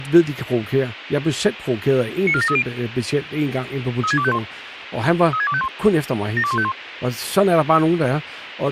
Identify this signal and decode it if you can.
Five-tone selective call (ZVEI), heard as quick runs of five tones, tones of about 70 ms, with radio hiss and speech in Danish. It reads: 94730 36251 36251 72151